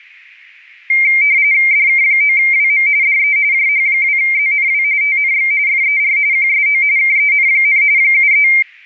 RTTY (45.45 baud, 170 Hz shift), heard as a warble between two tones, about 2200 Hz centre. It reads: DK9WM DE JH2ZNW TNX FER QSO KEN, 73